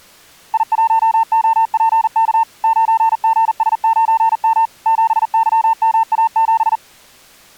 Morse code, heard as a keyed tone, machine-sent, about 40 wpm, 900 Hz. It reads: I1OPK 9GS9M 7YMA7